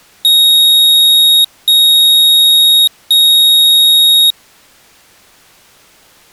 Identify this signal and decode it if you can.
Beep code, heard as a piezo beeper, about 3750 Hz. 3 long. In IBM BIOS tables: keyboard card error.